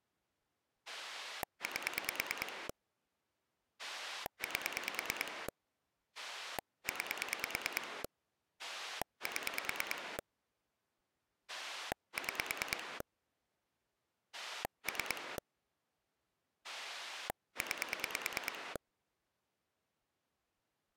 Pulse dialling, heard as a rotary dial, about 9 pulses a second. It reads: 8 8 9 7 6 3 9